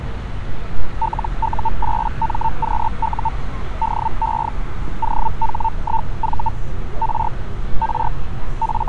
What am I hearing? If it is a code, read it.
Hellschreiber (Feld-Hell, 122.5 baud), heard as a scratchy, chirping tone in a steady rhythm, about 900 Hz, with street noise. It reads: LU8MQU DE OH1V R R …